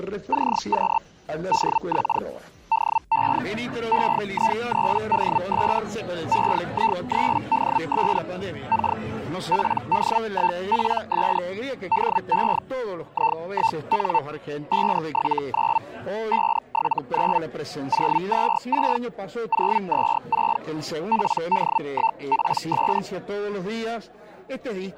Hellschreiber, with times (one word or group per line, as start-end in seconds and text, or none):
0.3-1.0 CQ
1.5-2.2 DX
2.7-3.4 DE
3.9-5.8 EI3DS
6.3-8.2 EI3DS
8.7-9.0 K
9.5-11.4 PD1PS
11.9-12.6 DE
13.1-14.2 I1N
14.7-15.8 579
16.3-17.4 579
17.9-19.0 026
19.5-20.6 026
21.1-23.0 PD1PS